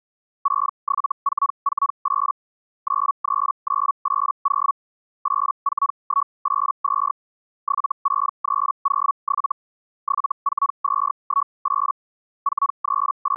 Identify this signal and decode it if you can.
Hellschreiber (Feld-Hell, 122.5 baud), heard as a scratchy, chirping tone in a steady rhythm, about 1120 Hz. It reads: 67448 93980 84182 76307 74218 …